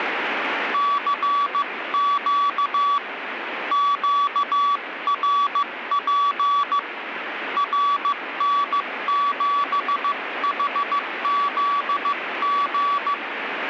Morse code, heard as a keyed tone, hand-sent with a paddle, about 15 wpm, 1140 Hz, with radio static. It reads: CQ QRP RN7HZG